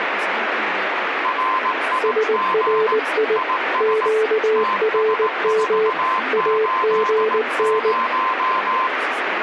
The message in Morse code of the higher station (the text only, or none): RIG IS TS480